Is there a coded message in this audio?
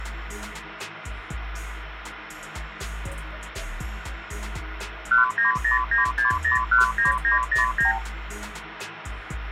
Yes: multi-frequency trunk signalling (R2, with the far end's replies) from 5.1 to 8.0 s, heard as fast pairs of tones, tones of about 130 ms, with phone line noise. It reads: 19096019909